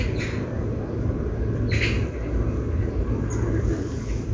The noise of a park. There is no code.